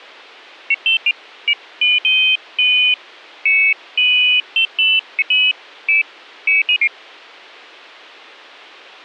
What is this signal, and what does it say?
Pairs of high tones at irregular times, with a squelch burst at the end. There is no code.